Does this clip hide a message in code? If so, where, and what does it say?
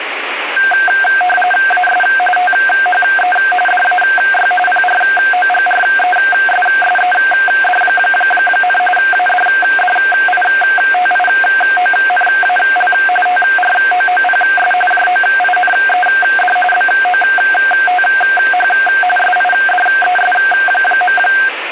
Yes: RTTY (45.45 baud, 850 Hz shift) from 0.6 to 21.5 s, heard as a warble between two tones, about 1150 Hz centre, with radio static. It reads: AS THE DAY PROGRESSED, ADDITIONAL TROOPS JOINED BOTH SIDES.